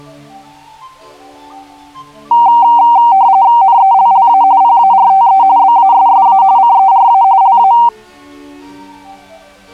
RTTY (45.45 baud, 170 Hz shift), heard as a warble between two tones, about 860 Hz centre. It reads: NELLA PARTE BASSA CERA LA